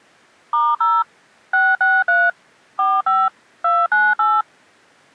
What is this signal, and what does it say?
DTMF, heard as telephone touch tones, dialled by machine, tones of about 220 ms. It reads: *0 663 45 298